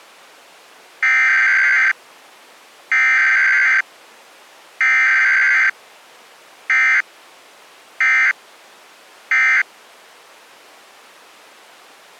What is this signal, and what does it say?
Emergency Alert System (SAME) tones (header bursts, then end-of-message bursts), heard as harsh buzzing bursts, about 520.83 baud.